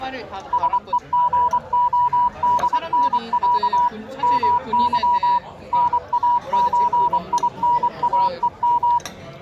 Morse code (Russian alphabet), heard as a keyed tone, machine-sent, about 24 wpm, 970 Hz, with the noise of a crowd indoors. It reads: СЕГОДНЯ МЫ НАЧИНАЕМ